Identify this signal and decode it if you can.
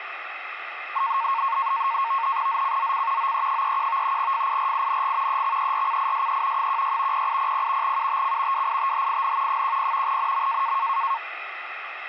NAVTEX (SITOR-B), 100 baud, 170 Hz shift, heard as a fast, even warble, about 1000 Hz centre, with radio static. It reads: ZCZC OE31 FIRING EXERCISE 16 0800 UTC WITHIN 10 NM